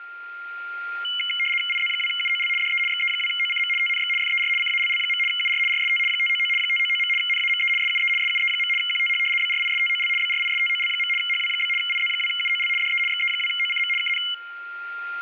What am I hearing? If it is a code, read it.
RTTY (75 baud, 850 Hz shift), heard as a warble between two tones, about 2550 Hz centre, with a steady whistle near 1400 Hz and room echo. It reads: IZ2UOL DE XE2OCM TNX FER CALL. UR RST 599 599. NAME SUE SUE. QTH BRISTOL BRISTOL. HW? IZ2UOL DE XE2OCM KN